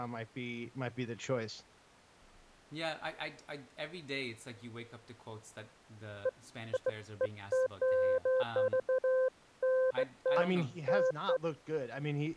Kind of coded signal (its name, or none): none